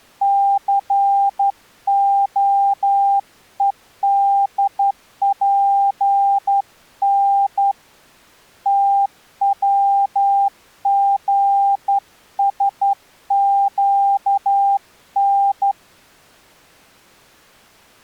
Morse code (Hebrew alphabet), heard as a keyed tone, hand-sent with a straight key, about 11 wpm, 800 Hz. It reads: סהודפן תצגשקן